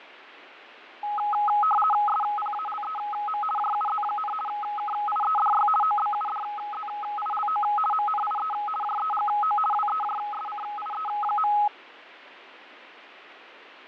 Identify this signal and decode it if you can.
RTTY (50 baud, 450 Hz shift), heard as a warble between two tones, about 1060 Hz centre, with radio static and fading. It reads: SPALEM JUZ, KIEDY OBUDZILO MNIE JEGO WEJSCIE.